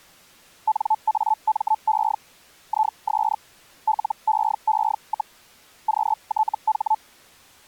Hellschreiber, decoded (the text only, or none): NAME IS LEE, QTH